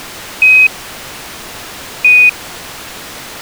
Quindar tones, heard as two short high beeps.